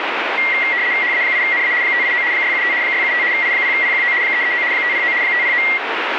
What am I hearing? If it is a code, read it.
RTTY (75 baud, 170 Hz shift), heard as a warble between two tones, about 2050 Hz centre, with radio static. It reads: HA8NA 589 675 675 I0PQO 339 509 509